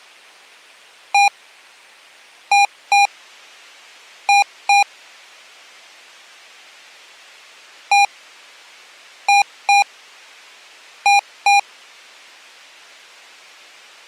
Beep code, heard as beeps from a small speaker, played twice, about 810 Hz. 1-2-2. In Phoenix BIOS tables: DMA initialisation failure.